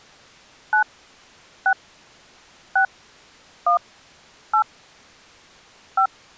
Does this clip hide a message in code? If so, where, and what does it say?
Yes: DTMF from 0.7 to 6.1 s, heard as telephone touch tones, dialled by hand, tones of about 90 ms. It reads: 9 6 6 1 8 5